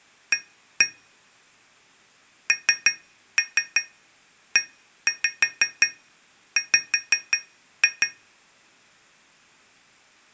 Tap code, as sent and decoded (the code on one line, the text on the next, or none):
1-1 / 3-3 1-5 5-2
A NEW